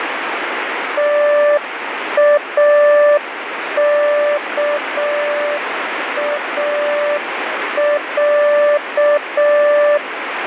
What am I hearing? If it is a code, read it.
Morse code (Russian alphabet), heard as a keyed tone, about 6 wpm, 590 Hz, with radio static. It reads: ТАКАЯ